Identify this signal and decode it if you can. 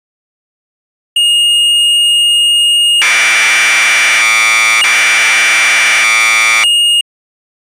Commodore tape loading (standard loader), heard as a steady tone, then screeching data.